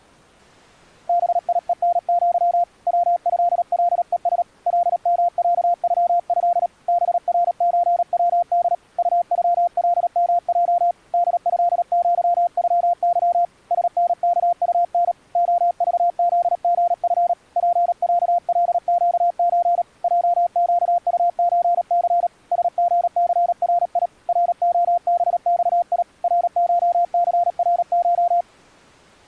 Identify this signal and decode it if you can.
Morse code (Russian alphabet), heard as a keyed tone, hand-sent with a paddle, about 37 wpm, 700 Hz. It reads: БИЕНЪ ВЭЛЕС ЛМЯЮЭ БРЧВД УЮЛМЙ ДЭЪЮЫ СНКУН ОЖЗГФ ПЯЛЩЧ ЙЩУЧЦ СГЦРИ РОБЬИ РШЦРШ